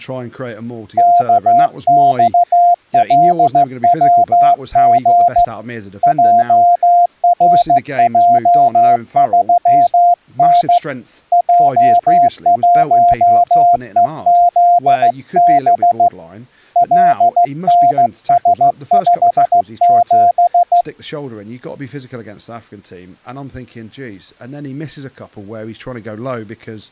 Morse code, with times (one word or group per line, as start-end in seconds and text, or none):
1.0-5.4 KXLWG
6.0-10.8 JRJ3N
11.3-16.1 J1EZB
16.8-20.8 LNS57